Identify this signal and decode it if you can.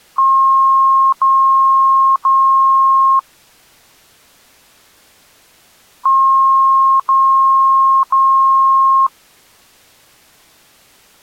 Beep code, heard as beeps, played twice, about 1070 Hz. 3 long. In IBM BIOS tables: keyboard card error.